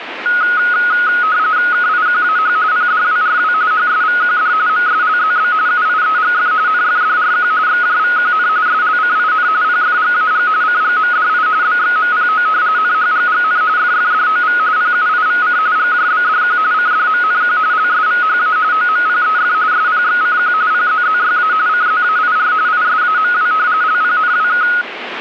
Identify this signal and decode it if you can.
RTTY (45.45 baud, 170 Hz shift), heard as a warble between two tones, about 1360 Hz centre, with radio static. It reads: KIQAH PDWRW HSVQD MSLZB UIEGF NFDRQ XJVQN SLCIN PFGAG CGMDI BXMPO NHGGN FFDOV PUIVC GJBDQ CDMNQ LSVHA OMPEF SPXCQ PZZYA CZAIR ISAMW LPNWK